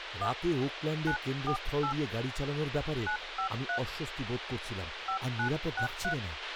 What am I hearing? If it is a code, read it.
DTMF, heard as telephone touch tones, dialled by hand, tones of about 100 ms, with radio hiss, a squelch burst at the end and speech in Bangla. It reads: 1 948 953 5963